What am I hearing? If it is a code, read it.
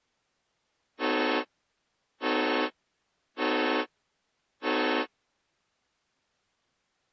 Train horn signal, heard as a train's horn. 4 short. On North American railways: a request for a signal to be given or repeated.